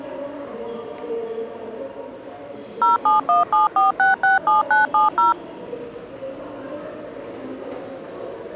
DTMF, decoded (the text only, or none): 07174667970